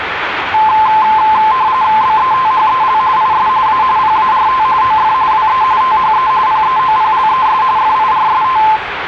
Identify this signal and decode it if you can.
RTTY (45.45 baud, 170 Hz shift), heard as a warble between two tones, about 960 Hz centre, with radio static and the noise of a residential street. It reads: BETHEL IS A PART OF WE THE PEOPLES FIRST